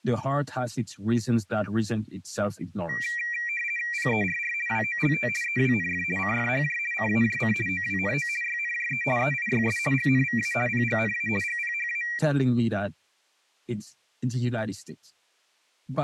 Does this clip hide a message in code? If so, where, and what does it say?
Yes: RTTY (50 baud, 450 Hz shift) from 2.9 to 12.2 s, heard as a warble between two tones, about 2150 Hz centre. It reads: PERR WOLT EWNF CFHJ CAJC OWNO YNJE EIYS GNVA PGNA GPHA